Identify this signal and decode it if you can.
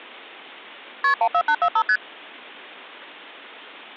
Multi-frequency trunk signalling (R1, as on North American trunks), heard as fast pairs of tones, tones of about 70 ms. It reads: KP 14845 ST